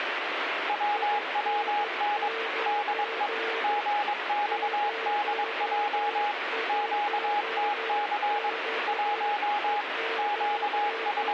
Morse code, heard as a keyed tone, machine-sent, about 22 wpm, 830 Hz, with radio static and a weaker station near 450 Hz. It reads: WWN DE GXDJ QTC 1 …